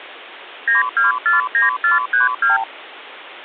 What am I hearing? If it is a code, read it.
Multi-frequency trunk signalling (R2, with the far end's replies), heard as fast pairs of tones, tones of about 150 ms. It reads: 9249432